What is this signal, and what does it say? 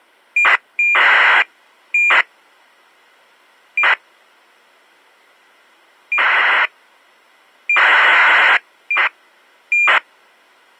ACARS aircraft data, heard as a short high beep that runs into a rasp, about 2400 baud.